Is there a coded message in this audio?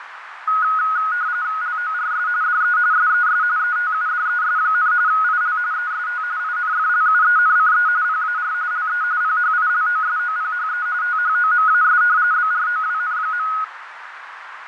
Yes: RTTY (45.45 baud, 170 Hz shift) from 0.5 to 13.6 s, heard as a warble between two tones, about 1360 Hz centre, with radio static, fading and a narrow filter. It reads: LORS DE SES ETUDES, IL EST INFLUENCE PAR LE PHILOSOPHE THOMAS BROWN.